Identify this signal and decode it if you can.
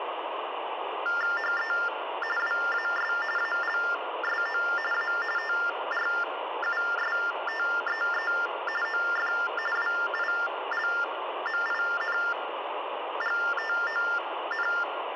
TTY/TDD text telephone tones (45.45 baud Baudot), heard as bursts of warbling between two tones, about 400 Hz shift, 1600 Hz centre, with phone line noise. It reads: HE WAS ALSO A TRUSTEE OF WILMINGTON